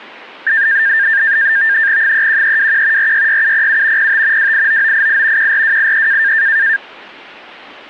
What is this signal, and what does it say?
NAVTEX (SITOR-B), 100 baud, 170 Hz shift, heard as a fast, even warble, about 1700 Hz centre. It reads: 31321 466707 05 289988 14283